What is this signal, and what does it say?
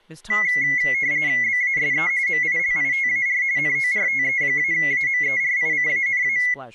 RTTY (45.45 baud, 170 Hz shift), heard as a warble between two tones, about 2050 Hz centre, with speech in English. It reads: BASE MILITAR NORTE-AMERICANA